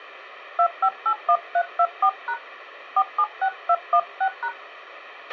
DTMF, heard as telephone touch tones, dialled by hand, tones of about 70 ms, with a squelch burst at the end. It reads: 2581324# 476216#